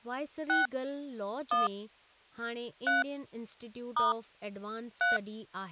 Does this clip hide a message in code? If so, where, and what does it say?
Yes: DTMF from 0.5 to 5.2 s, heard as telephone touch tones, dialled by hand, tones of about 160 ms, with speech in Sindhi. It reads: 6 1 3 * 3